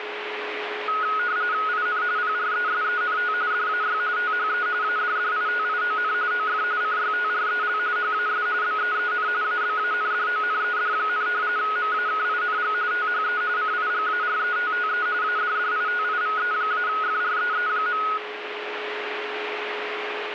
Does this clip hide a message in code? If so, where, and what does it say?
Yes: RTTY (45.45 baud, 170 Hz shift) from 0.9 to 18.2 s, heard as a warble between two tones, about 1360 Hz centre, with radio static and a steady whistle near 420 Hz. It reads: IN PRESENT DAY THE ADDITION OF CYTREL HAS BEEN ABANDONED, MAKING THE CIGARETTE ADDITIVE-FREE.